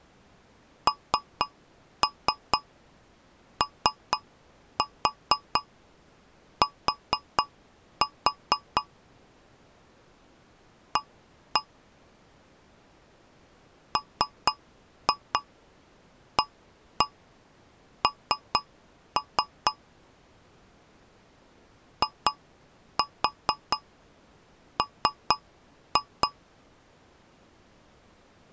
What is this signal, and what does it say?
Tap code, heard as taps on a metal pipe, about 4 knocks a second. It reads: NOT A MAN IM